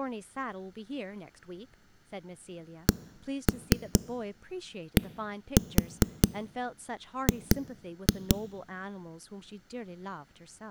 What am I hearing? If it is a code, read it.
Tap code, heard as knocks on a wall, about 4 knocks a second, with speech in English. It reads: CDG